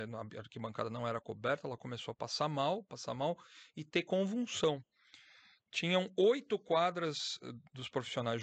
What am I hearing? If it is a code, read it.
Speech in Portuguese. There is no code.